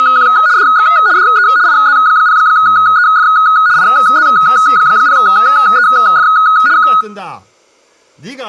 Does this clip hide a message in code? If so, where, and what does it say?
Yes: RTTY (75 baud, 170 Hz shift) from 0.0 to 7.0 s, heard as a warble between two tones, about 1360 Hz centre, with speech in Korean. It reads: … DX DE IZ0EF IZ0EF K